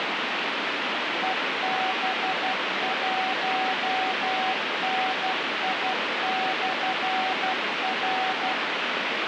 Morse code, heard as a keyed tone, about 12 wpm, 760 Hz, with heavy radio static. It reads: EB1NI/R